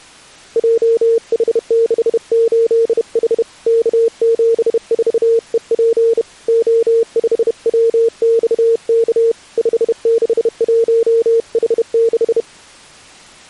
Morse code, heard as a keyed tone, hand-sent with a bug key, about 31 wpm, 460 Hz. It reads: JH68H K74EP O5WXK 561H6